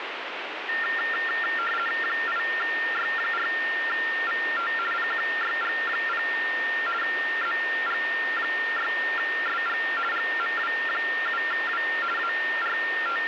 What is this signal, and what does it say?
RTTY (50 baud, 450 Hz shift), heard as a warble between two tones, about 1600 Hz centre, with radio static. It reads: 8Y4VT PQYG0 ZG6SG GMW7W …